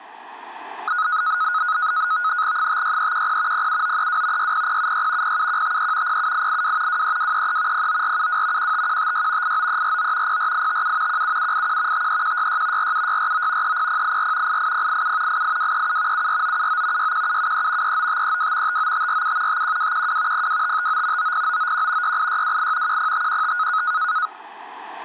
NAVTEX (SITOR-B), 100 baud, 170 Hz shift, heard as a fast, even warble, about 1360 Hz centre. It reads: 56310 07932 60076 07153 07882 23233 09472 15156 89349 04857 17781 53166 47649 30084 88087 88237 74979 61773 39532 59547 51212 02559 90991 68628 10515